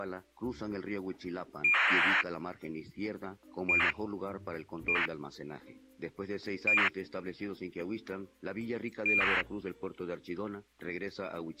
ACARS aircraft data, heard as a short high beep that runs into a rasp, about 2400 baud.